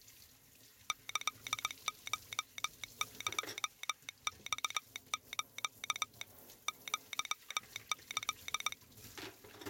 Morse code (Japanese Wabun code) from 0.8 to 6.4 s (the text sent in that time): キコエマス